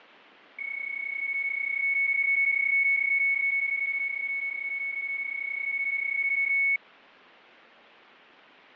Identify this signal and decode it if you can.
PSK31 (31.25 baud), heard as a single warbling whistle, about 2200 Hz, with fading.